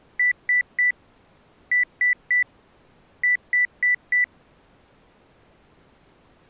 Beep code, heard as beeps from a small speaker, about 2000 Hz. 3-3-4. In Phoenix BIOS tables: video failure.